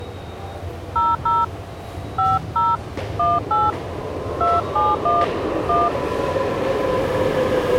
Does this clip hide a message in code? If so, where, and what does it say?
Yes: DTMF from 1.0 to 5.9 s, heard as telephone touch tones, dialled by hand, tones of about 200 ms, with the noise of a subway station. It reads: 00 50 18 271 1